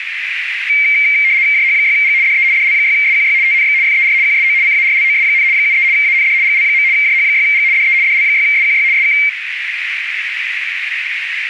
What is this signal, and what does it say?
RTTY (75 baud, 170 Hz shift), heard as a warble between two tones, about 2200 Hz centre, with radio static and a narrow filter. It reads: JH6G DE DL6SQY TNX FER QSO CARLOS, 73 AND GL. JH6G DE DL6SQY SK